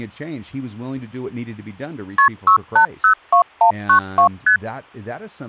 Multi-frequency trunk signalling (R1, as on North American trunks), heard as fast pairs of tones, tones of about 100 ms, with speech in English. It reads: KP 6802192 ST